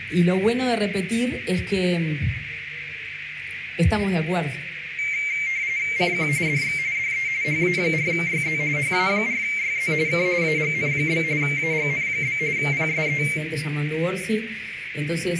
RTTY (45.45 baud, 170 Hz shift), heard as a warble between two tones, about 2200 Hz centre, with radio static and a narrow filter. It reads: CQ DX DE HA4YZ HA4YZ K AGN? AGN? PSE